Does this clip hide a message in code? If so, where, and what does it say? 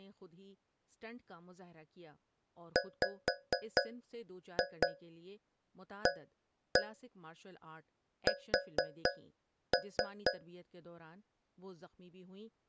Yes: tap code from 2.8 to 10.6 s, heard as taps on a metal pipe, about 4 knocks a second, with speech in Urdu. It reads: WAS